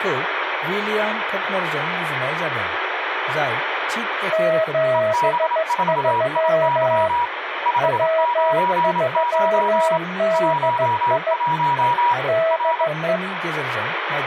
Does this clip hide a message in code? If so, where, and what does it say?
Yes: Morse code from 4.3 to 13.2 s, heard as two keyed tones, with radio static and speech in Bodo. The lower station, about 15 wpm, 650 Hz: 73 W3DI DE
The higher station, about 27 wpm, 960 Hz: EB4IY 599 11 R